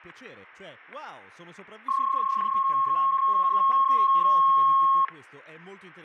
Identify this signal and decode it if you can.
PSK31 (31.25 baud), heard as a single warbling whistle, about 1080 Hz, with static crashes and speech in Italian.